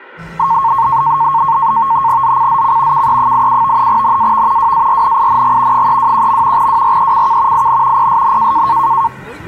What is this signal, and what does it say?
NAVTEX (SITOR-B), 100 baud, 170 Hz shift, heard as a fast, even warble, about 1000 Hz centre, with the noise of a park. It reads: ZCZC KE87 NAV WARNING 321. WRECK IN PSN